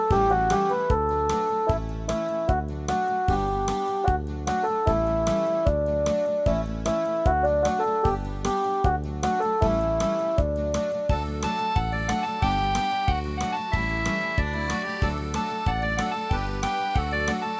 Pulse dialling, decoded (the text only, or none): none